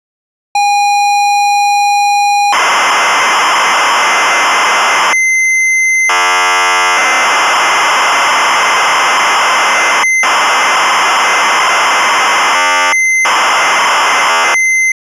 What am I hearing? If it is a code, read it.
ZX Spectrum tape loading, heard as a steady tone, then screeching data.